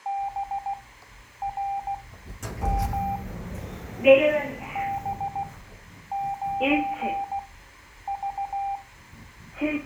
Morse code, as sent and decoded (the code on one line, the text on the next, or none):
-... .-. -- / -... ----. ...-
BRM B9V